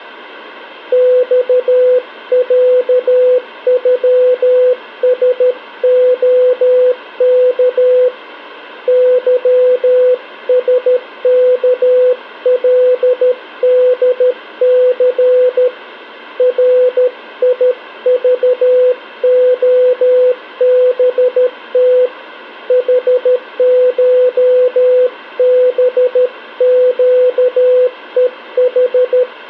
Morse code (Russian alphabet), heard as a keyed tone, hand-sent with a paddle, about 13 wpm, 500 Hz. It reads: ЬЯЮСОК ЫСКЛДЦ РИЖОБТ ХШБЩЕХ